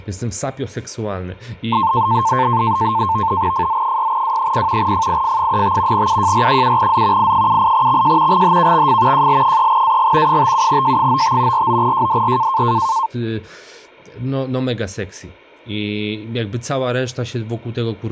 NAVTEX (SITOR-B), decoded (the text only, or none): FZ6W0 FIF35 UJR7Z I78XJ GHKXF JL3AG 57J95 49JDR